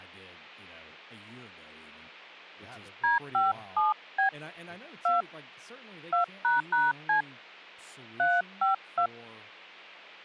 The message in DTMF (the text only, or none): D57B 2 2##C 352